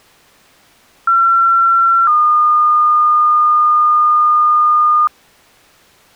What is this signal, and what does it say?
Two-tone page, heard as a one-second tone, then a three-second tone, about 1360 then 1220 Hz.